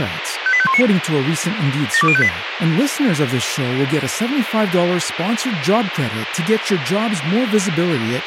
Five-tone selective call (ZVEI), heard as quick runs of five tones, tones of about 70 ms, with radio hiss and speech in Italian. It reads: 58519 72058